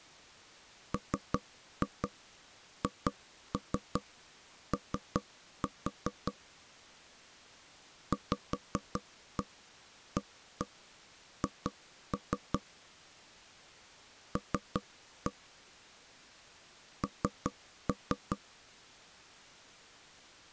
Tap code, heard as knocks on wood, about 5 knocks a second. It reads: MHO VAH L N